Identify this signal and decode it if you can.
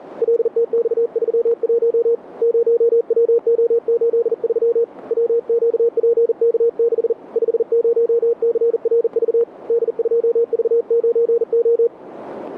Morse code, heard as a keyed tone, hand-sent with a bug key, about 40 wpm, 470 Hz, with radio static. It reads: LTX31 0WO83 WQPK6 50CRV D2V9O